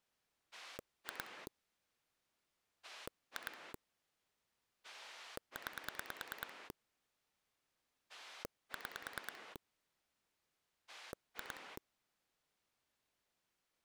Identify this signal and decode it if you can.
Pulse dialling, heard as a rotary dial, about 9 pulses a second. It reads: 2 2 9 6 2